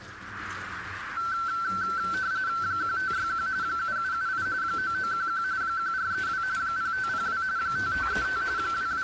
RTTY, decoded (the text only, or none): 1561 7778 9911 1432 0502 5535 …